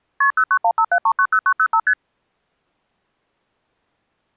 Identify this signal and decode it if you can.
Multi-frequency trunk signalling (R1, as on North American trunks), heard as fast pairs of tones, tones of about 70 ms. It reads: KP 09157390905 ST